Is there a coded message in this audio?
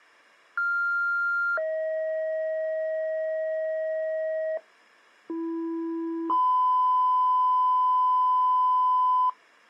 Yes: two-tone page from 0.6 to 9.3 s, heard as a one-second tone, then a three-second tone, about 1400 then 630 Hz, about 330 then 1010 Hz.